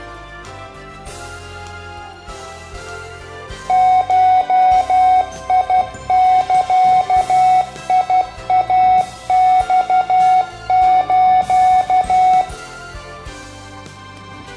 Morse code (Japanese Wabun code), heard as electronic beeps, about 12 wpm, 740 Hz, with room echo. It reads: ゴザイマス